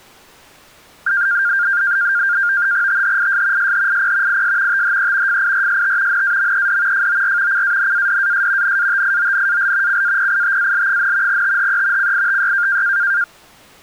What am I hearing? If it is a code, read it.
NAVTEX (SITOR-B), 100 baud, 170 Hz shift, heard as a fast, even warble, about 1500 Hz centre. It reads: THIS SHIP IS THE FIRST NAMED FOR CANADAS NATIONAL CAPITAL, THE CITY